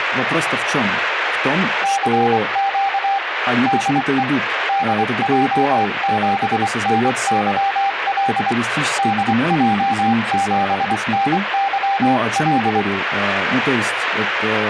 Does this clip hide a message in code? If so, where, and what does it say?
Yes: Morse code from 1.8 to 12.9 s, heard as a keyed tone, hand-sent with a paddle, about 24 wpm, 790 Hz, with radio static and speech in Russian. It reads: CQ DE DJ7NYL DJ7NYL